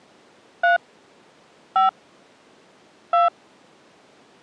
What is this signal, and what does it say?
DTMF, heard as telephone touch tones, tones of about 150 ms. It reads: 3 5 2